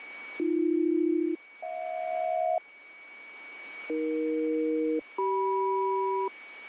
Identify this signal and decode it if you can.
Aircraft SELCAL, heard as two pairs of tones, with radio static and a steady whistle near 2260 Hz. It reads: AB-HJ AE-CM